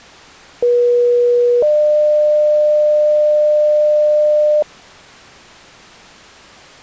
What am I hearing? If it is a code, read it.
Two-tone page, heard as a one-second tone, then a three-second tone, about 480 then 600 Hz.